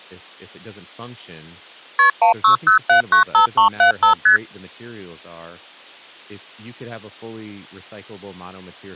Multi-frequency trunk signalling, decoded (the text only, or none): KP 160795375 ST